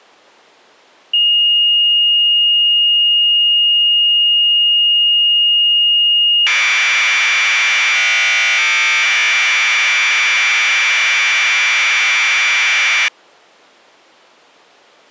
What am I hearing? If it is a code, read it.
Commodore tape loading (standard loader), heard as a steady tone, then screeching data.